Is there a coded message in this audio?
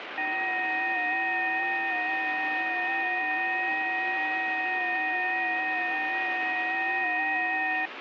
Yes: FT8 (several signals at once) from 0.2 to 7.9 s, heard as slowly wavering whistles, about 6.25 baud, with radio static.